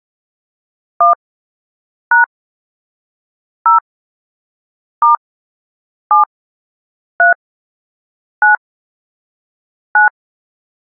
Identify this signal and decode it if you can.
DTMF, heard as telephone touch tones, dialled by hand, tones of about 130 ms. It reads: 1 # 0 * 7 3 9 9